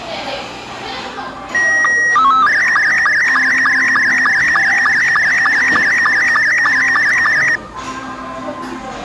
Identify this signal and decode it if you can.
SSTV (slow-scan television), Robot 72, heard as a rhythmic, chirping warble, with the noise of a cafe.